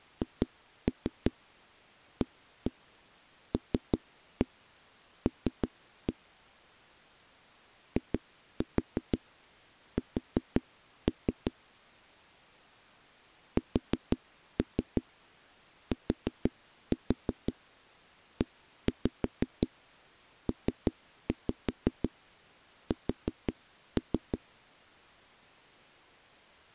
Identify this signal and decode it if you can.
Tap code, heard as knocks on a wall, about 5 knocks a second. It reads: HALL IS STEPS